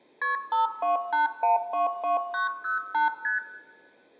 Multi-frequency trunk signalling (R1, as on North American trunks), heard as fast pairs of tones, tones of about 140 ms, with room echo. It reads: KP 528122908 ST